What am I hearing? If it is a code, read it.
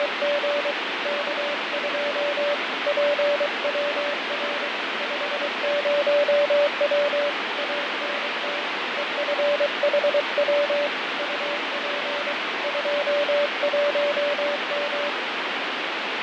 Morse code, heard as a keyed tone, hand-sent with a paddle, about 23 wpm, 580 Hz, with heavy radio static and fading. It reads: … K2 PWR 50W ANT EFHW UP 21M